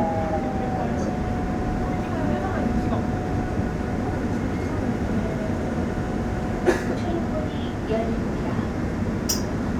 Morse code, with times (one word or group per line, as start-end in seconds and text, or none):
none